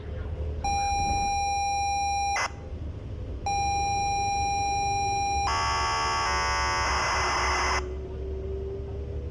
ZX Spectrum tape loading, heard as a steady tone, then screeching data, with the noise inside a bus.